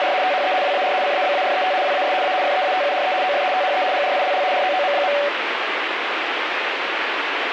RTTY (75 baud, 170 Hz shift), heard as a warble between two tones, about 660 Hz centre, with radio static. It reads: … THE WAR CABARET WAS A FEATURE OF THE GRILL ROOM.